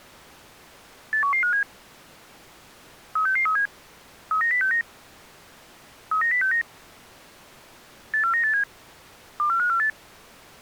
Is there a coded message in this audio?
Yes: five-tone selective call (CCIR) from 1.1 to 9.9 s, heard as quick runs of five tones, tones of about 100 ms. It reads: 81157 36637 39069 39069 84987 24548